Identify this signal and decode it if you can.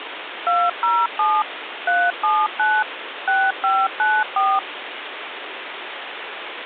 DTMF, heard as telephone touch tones, dialled by machine, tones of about 230 ms, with phone line noise. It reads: 207 379 6594